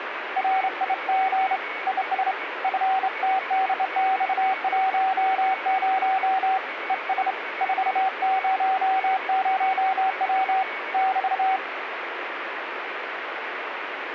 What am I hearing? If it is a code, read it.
Morse code, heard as a keyed tone, hand-sent with a straight key, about 28 wpm, 760 Hz, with radio static and a weaker station near 2230 Hz. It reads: RIG IS FTDX10 ES 400W <BT>